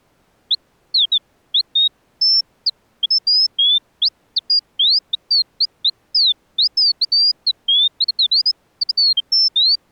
Bird-like chirps. There is no code.